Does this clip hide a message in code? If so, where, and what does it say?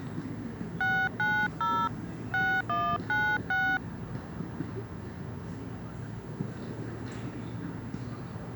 Yes: DTMF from 0.8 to 3.8 s, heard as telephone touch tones, dialled by hand, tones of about 270 ms, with the noise of a park. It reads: 690 6196